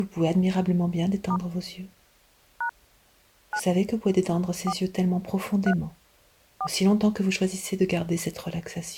DTMF, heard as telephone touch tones, dialled by hand, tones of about 80 ms. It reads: * # 9 4 3 4